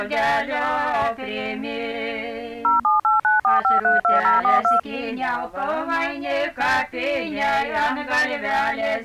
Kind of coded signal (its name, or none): DTMF